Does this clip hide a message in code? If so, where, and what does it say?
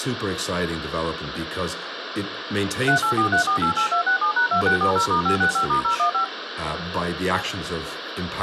Yes: DTMF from 2.9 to 6.2 s, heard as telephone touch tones, dialled by machine, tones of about 100 ms, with phone line noise and speech in English. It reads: 3843488267#2640*565*015